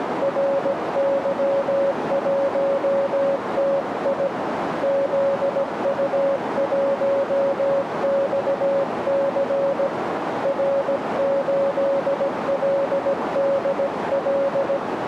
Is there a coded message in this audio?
Yes: Morse code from 0.2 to 14.8 s, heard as a keyed tone, hand-sent with a paddle, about 17 wpm, 550 Hz, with radio static and a narrow filter. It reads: RY1TI ZU1XC R8LDL